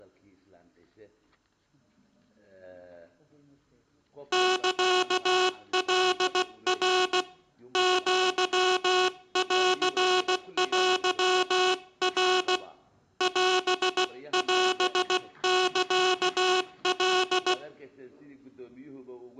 Morse code (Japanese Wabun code), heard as a buzzer, hand-sent with a paddle, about 16 wpm. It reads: サカナ アンテナ オオサカ